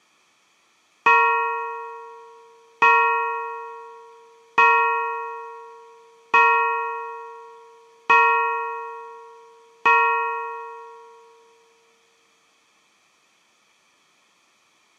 Clock strike, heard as a bell. 6. Six o'clock.